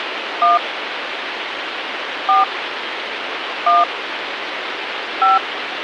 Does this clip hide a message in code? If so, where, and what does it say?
Yes: DTMF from 0.4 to 5.4 s, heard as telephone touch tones, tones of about 170 ms, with phone line noise. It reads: 1 4 1 5